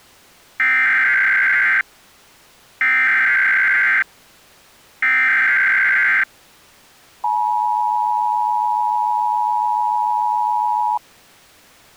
Emergency Alert System (SAME) tones (header bursts, then the 853 and 960 Hz attention tone), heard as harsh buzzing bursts, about 520.83 baud.